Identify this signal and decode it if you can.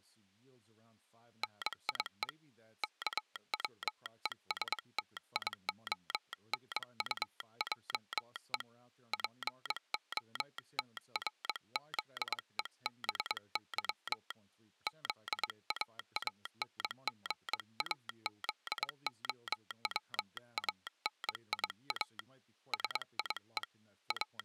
Morse code, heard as a telegraph sounder, hand-sent with a paddle, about 22 wpm, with speech in English. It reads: NIE KWESTIONUJE POTRZEBY ZAANGAZOWANIA SIE …